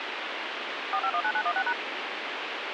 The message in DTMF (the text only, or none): 4519916#